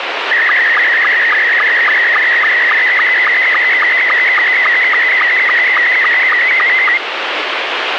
SSTV (slow-scan television), Scottie S2, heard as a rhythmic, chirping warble, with radio static.